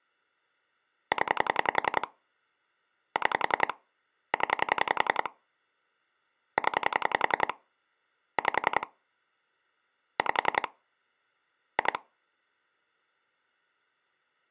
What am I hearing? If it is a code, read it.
Pulse dialling, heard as clicks on a phone line, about 10 pulses a second. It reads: 0 6 0 0 5 5 2